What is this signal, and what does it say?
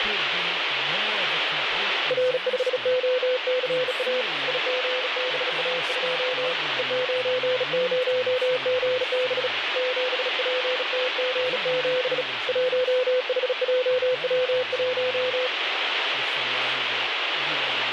Morse code, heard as a keyed tone, hand-sent with a bug key, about 36 wpm, 510 Hz, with radio static and speech in English. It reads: R5OCA IGBA2 E90GB 7PTG7 1HJW1